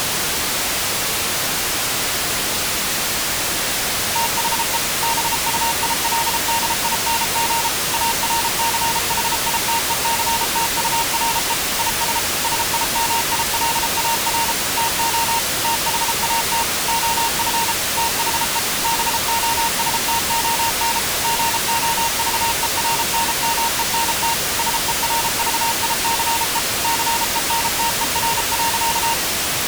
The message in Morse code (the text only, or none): THE BUILDING ARCHITECTURE IS SIMILAR TO THAT OF THE BOSTON GOVERNMENT SERVICE CENTER.